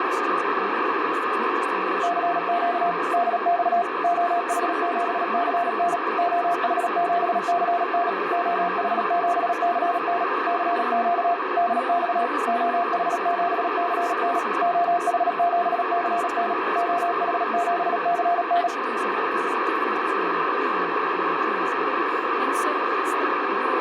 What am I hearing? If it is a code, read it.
Morse code, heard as a keyed tone, machine-sent, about 37 wpm, 700 Hz, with radio static and speech in English. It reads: CQ DX OH7CN OH7CN OH7CN CQ DX OH7CN OH7CN OH7CN